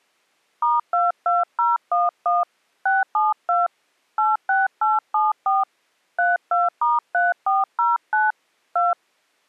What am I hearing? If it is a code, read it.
DTMF, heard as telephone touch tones, dialled by hand, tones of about 180 ms. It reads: *22011 672 86874 32*3409 2